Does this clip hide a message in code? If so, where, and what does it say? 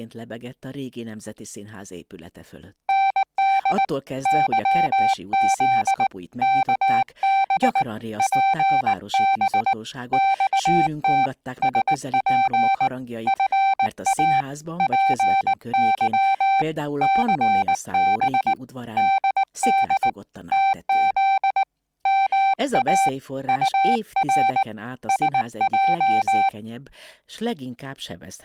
Yes: Morse code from 2.8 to 26.5 s, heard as a keyed tone, hand-sent with a paddle, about 19 wpm, 780 Hz, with speech in Hungarian. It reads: ND YZ KB PB XT SP FA PY CB DD TZ MA UR SJ